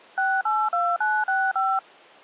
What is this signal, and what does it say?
DTMF, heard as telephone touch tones, dialled by machine, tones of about 240 ms. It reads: 682965